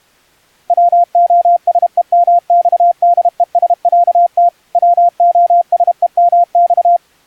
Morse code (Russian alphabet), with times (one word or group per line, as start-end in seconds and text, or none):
0.7-4.5 ВОСЕМЬДЕСЯТ
4.8-7.0 ВОСЕМЬ